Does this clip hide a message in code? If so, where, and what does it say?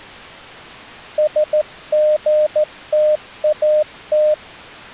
Yes: Morse code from 1.1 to 4.4 s, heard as a keyed tone, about 14 wpm, 610 Hz. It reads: SGTAT